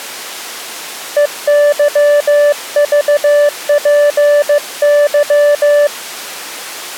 Morse code, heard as a keyed tone, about 15 wpm, 580 Hz. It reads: EYVPY